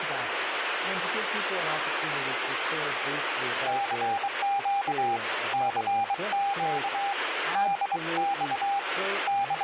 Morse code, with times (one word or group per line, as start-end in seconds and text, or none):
3.7-5.2 CQ
5.5-7.1 CQ
7.6-8.8 DX
9.3-9.6 …